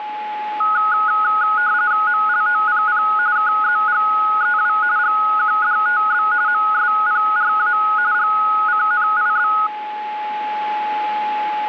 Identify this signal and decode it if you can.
RTTY (45.45 baud, 170 Hz shift), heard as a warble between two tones, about 1360 Hz centre, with a steady whistle near 850 Hz. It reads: MLOPP KZGEW GQDTB MSPRA GCNIB